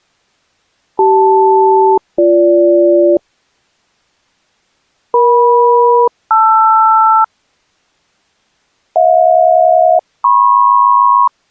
Aircraft SELCAL, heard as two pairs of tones. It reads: CL-BG EM-LR HJ-MP